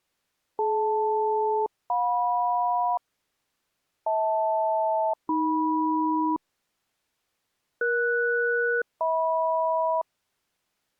Aircraft SELCAL, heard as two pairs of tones. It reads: DL-JM HL-AM ES-HM